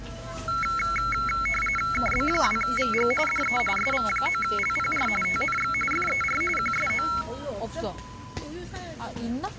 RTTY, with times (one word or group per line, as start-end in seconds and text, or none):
1.9-3.1 KB2VG
3.3-3.6 DE
3.8-5.1 SV9LPR
5.2-5.7 TNX
5.9-6.4 FER
6.6-7.1 QSO